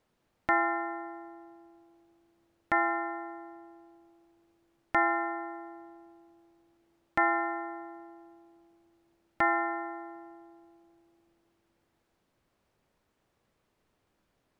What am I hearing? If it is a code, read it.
Clock strike, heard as a bell. 5. Five o'clock.